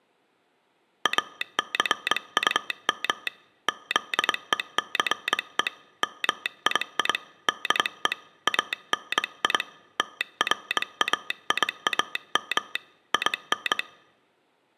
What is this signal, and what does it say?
Morse code, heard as a telegraph sounder, hand-sent with a straight key, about 22 wpm. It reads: ACUM ZECE MII DE ANI TRAIAM IN